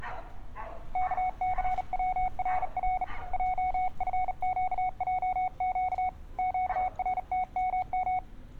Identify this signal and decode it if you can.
Morse code, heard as a keyed tone, hand-sent with a bug key, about 38 wpm, 740 Hz, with street noise. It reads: KCWRR JFQJQ QRTMM